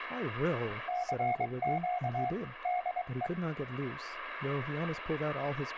Morse code, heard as a keyed tone, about 23 wpm, 720 Hz, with radio static, room echo and speech in English. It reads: CQ DE